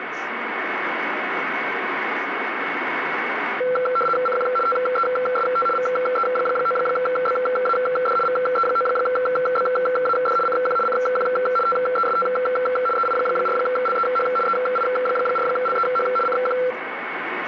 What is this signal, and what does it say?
RTTY (75 baud, 850 Hz shift), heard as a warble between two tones, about 930 Hz centre, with radio static. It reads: CQ TEST VE9BAD VE9BAD CQ CQ TEST EI4LEH EI4LEH CQ